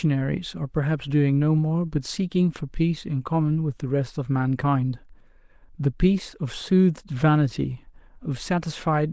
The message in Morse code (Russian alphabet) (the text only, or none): none